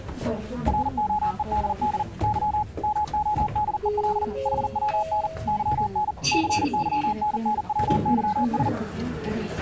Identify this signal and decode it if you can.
Morse code, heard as a keyed tone, machine-sent, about 40 wpm, 840 Hz, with the noise inside a lift. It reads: ROEDD Y MODEL HWN YN CYNNWYS